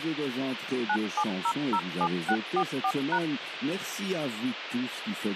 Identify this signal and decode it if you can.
DTMF, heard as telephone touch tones, dialled by machine, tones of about 70 ms, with radio hiss. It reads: 97007644#